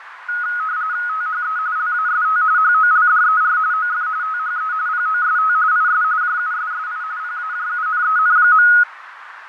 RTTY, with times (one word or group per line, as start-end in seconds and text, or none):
1.1-1.6 THE
1.8-2.4 LAST
2.6-3.6 HOLDER
3.7-4.1 OF
4.2-4.7 THE
4.9-5.5 POST
5.7-6.0 IS
6.2-7.0 JUSSI
7.2-8.7 PAJUNEN.